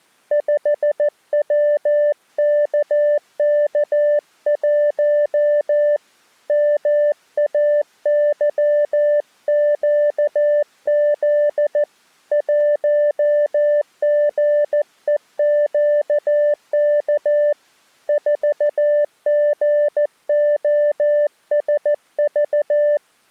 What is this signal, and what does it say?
Morse code, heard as a keyed tone, hand-sent with a paddle, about 14 wpm, 590 Hz. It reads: 5WKK1 MAYQZ 1GEQK 4GOSV